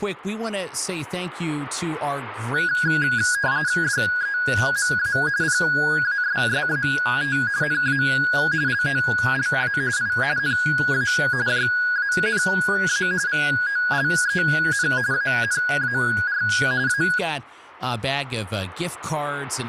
RTTY (45.45 baud, 170 Hz shift), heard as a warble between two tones, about 1550 Hz centre, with speech in English. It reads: DEMA PASSAT NA LOLA I NA JANA VOLEN ANAR A